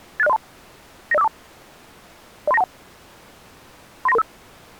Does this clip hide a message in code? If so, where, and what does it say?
Yes: five-tone selective call (EIA) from 0.2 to 4.2 s, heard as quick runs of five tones, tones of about 30 ms. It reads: 86032 90542 03921 39335